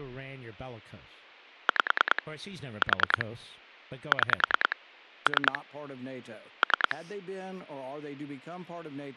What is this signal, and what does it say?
Pulse dialling, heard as clicks on a phone line, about 10 pulses a second, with speech in English. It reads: 5 4 6 3 3